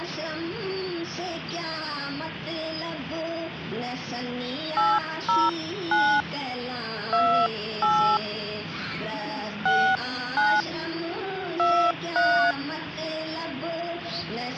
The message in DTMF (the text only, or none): 809 28 69 23